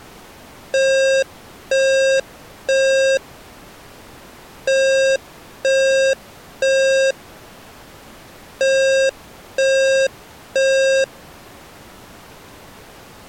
Alarm pattern, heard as an alarm's beeps, played three times, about 540 Hz. Temporal three. Smoke or fire, evacuate.